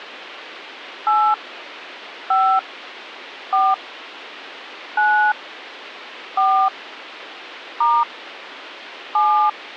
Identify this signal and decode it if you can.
DTMF, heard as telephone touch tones, dialled by hand, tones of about 250 ms. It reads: 8 5 4 9 4 * 7